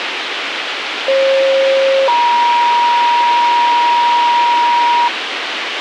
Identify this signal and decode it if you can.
Two-tone page, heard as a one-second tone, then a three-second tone, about 540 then 950 Hz, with radio hiss.